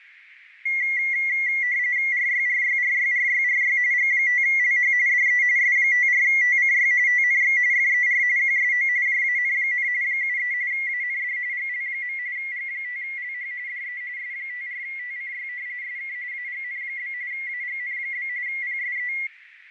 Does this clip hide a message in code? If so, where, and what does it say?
Yes: RTTY (45.45 baud, 170 Hz shift) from 0.7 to 19.3 s, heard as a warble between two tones, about 2050 Hz centre, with radio static, fading and a narrow filter. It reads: RYRYRYRYRY G5LH DE S54TCY TNX FER QSO JAN, 73 AND GL. G5LH DE S54TCY SK AGN? AGN? PSE